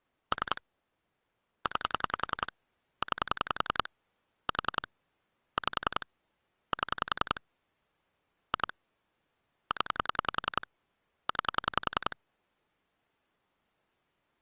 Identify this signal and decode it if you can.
Pulse dialling, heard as clicks on a phone line, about 10 pulses a second. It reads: 3 9 9 4 5 7 2 0 9